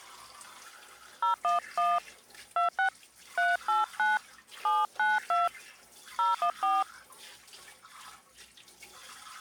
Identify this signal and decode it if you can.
DTMF, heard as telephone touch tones, dialled by hand, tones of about 150 ms, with kitchen noise. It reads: 011 26 389 792 014